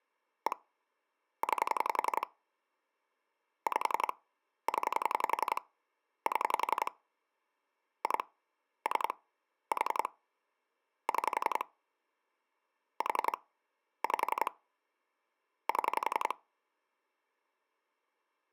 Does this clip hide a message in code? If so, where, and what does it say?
Yes: pulse dialling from 0.5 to 16.3 s, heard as clicks on a phone line, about 11 pulses a second. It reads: 1 9 5 0 7 2 3 4 6 4 5 7